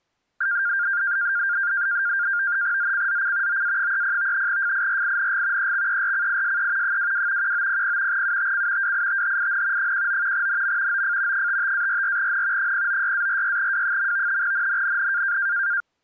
NAVTEX (SITOR-B), 100 baud, 170 Hz shift, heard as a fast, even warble, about 1500 Hz centre. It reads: ZCZC OA30 FIRING EXERCISE 22 1900 UTC WITHIN 19 NM OF 55-44N 096-46W. NNNN